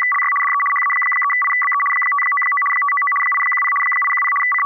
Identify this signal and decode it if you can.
RTTY (75 baud, 850 Hz shift), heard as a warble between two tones, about 1550 Hz centre. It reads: … DE HA3IBE 599 599 810 810 …